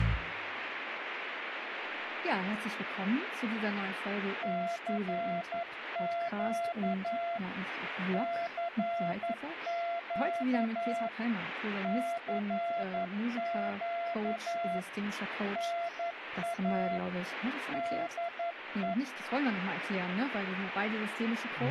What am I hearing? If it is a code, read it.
Morse code, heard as a keyed tone, machine-sent, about 11 wpm, 680 Hz, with radio static. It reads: CQ CQ CQ NA DE